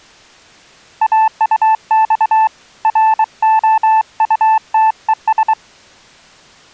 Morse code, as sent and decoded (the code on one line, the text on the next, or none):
.- ..- -..- / .-. --- ..- - . ...
AUX ROUTES